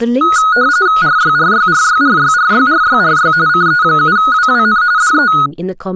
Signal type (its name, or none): RTTY